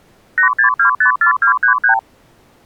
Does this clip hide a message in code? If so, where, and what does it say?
Yes: multi-frequency trunk signalling (R2, with the far end's replies) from 0.4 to 2.0 s, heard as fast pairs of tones, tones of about 100 ms. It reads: 86254233